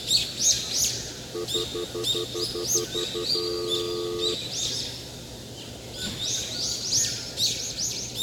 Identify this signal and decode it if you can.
Telephone call progress tone (North American plan), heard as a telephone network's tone, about 350, 440 Hz, 0.1 s on and 0.1 s off, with the noise of a park. Stutter dial tone.